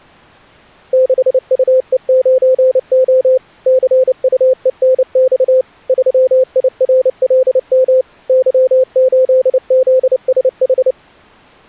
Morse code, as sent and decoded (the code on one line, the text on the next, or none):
-.... ..- . ----. --- / -.-. ..- . -. -..- / ...-- .. .-. .-.. -- / -.-- ---.. --.. ... ....
6UE9O CUENX 3IRLM Y8ZSH